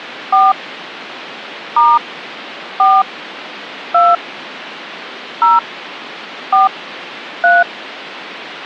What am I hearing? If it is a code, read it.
DTMF, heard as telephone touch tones, dialled by hand, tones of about 200 ms. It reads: 4 * 4 2 0 4 3